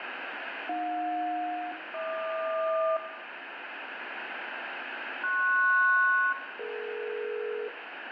Aircraft SELCAL, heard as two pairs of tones, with radio static. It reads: AJ-HQ PS-DE